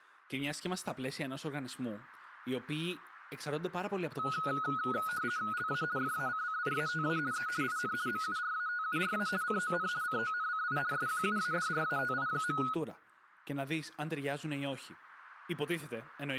RTTY (50 baud, 170 Hz shift), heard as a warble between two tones, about 1360 Hz centre, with speech in Greek. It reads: LA FACCIATA E IN MURATURA CON CONCI SQUADRATI.